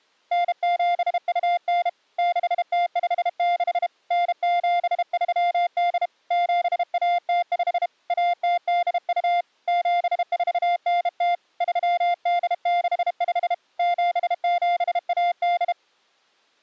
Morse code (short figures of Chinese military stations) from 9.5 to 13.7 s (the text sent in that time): 7490 3865